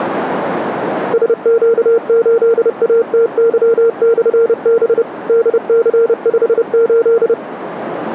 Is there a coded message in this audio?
Yes: Morse code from 1.1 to 7.4 s, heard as a keyed tone, machine-sent, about 30 wpm, 460 Hz, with radio static. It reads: SQ8ATY/B DC58